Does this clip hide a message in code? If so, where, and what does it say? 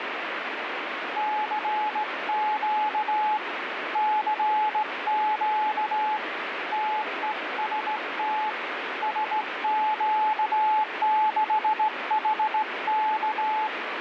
Yes: Morse code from 1.1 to 13.7 s, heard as a keyed tone, hand-sent with a straight key, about 17 wpm, 860 Hz, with radio static. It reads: CQ CQ TEST SQ6HK